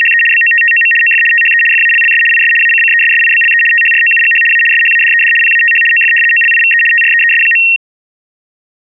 RTTY (75 baud, 850 Hz shift), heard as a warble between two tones, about 2300 Hz centre. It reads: … BOTTOM OF THE FALLS IS ACCESSIBLE THROUGH A SHADED PATH OF OLIVE TREES.